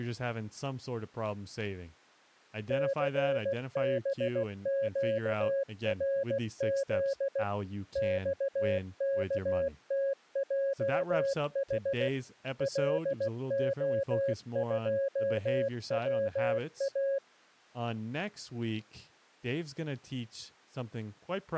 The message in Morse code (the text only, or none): CBQRZ XKTJH LO2WA